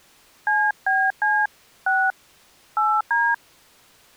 DTMF, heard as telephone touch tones, dialled by hand, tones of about 240 ms. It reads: CBC 6 8D